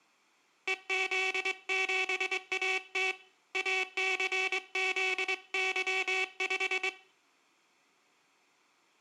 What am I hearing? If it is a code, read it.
Morse code, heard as a buzzer, hand-sent with a straight key, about 23 wpm, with room echo. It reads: EZ7AT ACZY5